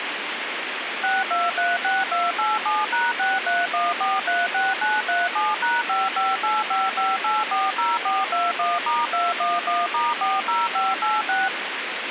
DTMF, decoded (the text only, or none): 6236287#631436937#55855840421*211*40586